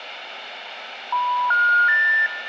Telephone call progress tone (North American plan), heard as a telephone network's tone, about 980, 1430, 1800 Hz, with room echo. Special information tone.